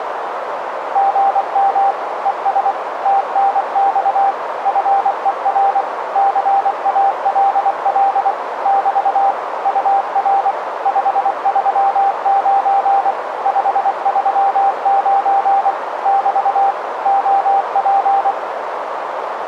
Morse code, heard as a keyed tone, machine-sent, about 24 wpm, 790 Hz, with radio static and a narrow filter. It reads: GM ES TNX FER CALL <BT> UR 539 539 <BT> OP